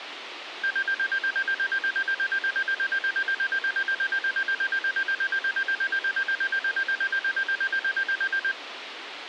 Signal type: none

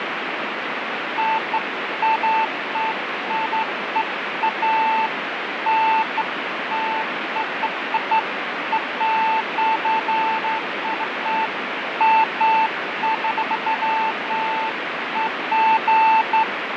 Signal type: none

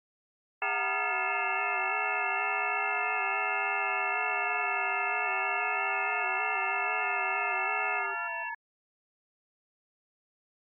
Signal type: FT8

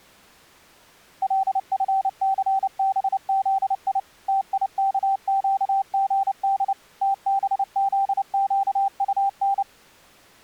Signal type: Morse code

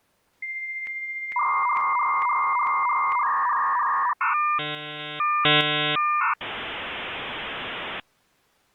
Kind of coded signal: dial-up modem handshake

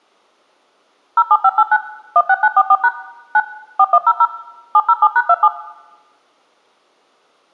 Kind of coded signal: DTMF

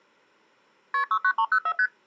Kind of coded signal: multi-frequency trunk signalling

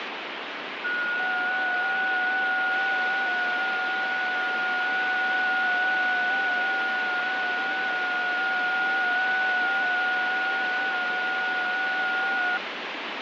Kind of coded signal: FT8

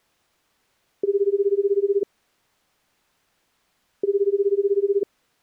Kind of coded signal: telephone call progress tone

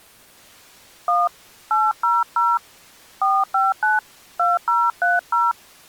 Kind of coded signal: DTMF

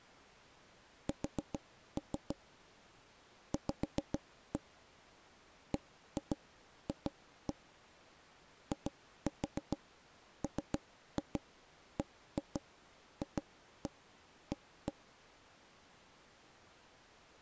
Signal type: tap code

